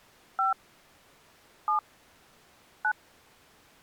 DTMF, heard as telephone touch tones, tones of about 110 ms. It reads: 5 7 9